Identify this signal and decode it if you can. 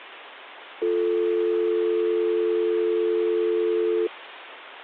Telephone call progress tone (North American or UK plan), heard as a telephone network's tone, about 350, 440 Hz. Dial tone.